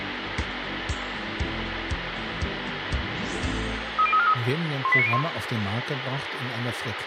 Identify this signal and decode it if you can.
Five-tone selective call (ZVEI), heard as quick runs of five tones, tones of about 70 ms, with radio hiss and room echo. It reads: 30343 18901